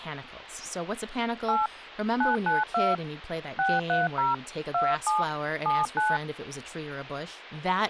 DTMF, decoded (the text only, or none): 8 992 630 27 79